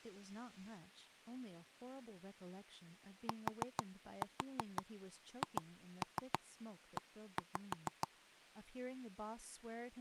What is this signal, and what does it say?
Tap code, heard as knocks on wood, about 6 knocks a second, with speech in English. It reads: THE